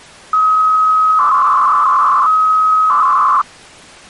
300-baud modem data (Bell 103 tones), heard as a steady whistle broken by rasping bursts, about 300 baud, 200 Hz shift.